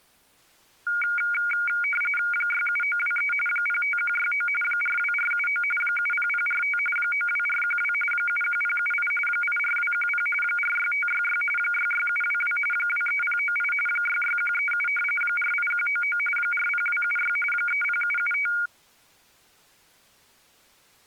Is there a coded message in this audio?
Yes: RTTY (45.45 baud, 850 Hz shift) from 0.9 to 18.7 s, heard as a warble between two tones, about 1850 Hz centre. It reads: 67923 05169 42479 70045 92412 71078 84210 46566 66722 23098 66137 48199 40276 30775